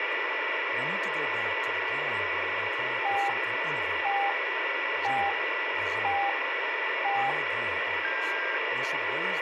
Radio time signal (five pips and a higher one, as on Chinese radio), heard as pips, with radio static, a steady whistle near 1970 Hz and speech in English.